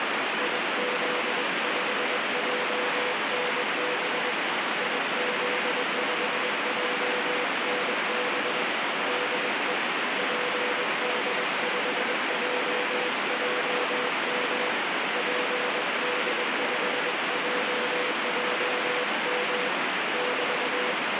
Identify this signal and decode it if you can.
Morse code, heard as a keyed tone, hand-sent with a paddle, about 21 wpm, 500 Hz, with heavy radio static. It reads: IZ5JNB IZ5JNB DE PD5JJM PD5JJM <BT>